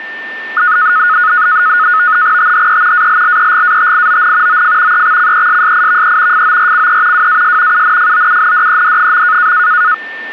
NAVTEX (SITOR-B), 100 baud, 170 Hz shift, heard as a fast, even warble, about 1360 Hz centre, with a steady whistle near 1790 Hz. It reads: THE ALLEGATION OF EXCESSIVE FORCE WAS UNFOUNDED.